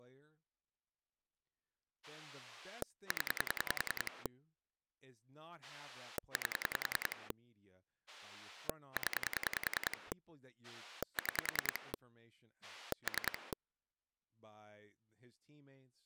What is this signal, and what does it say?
Pulse dialling, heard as a rotary dial, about 10 pulses a second, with speech in English. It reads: 0 8 0 6 3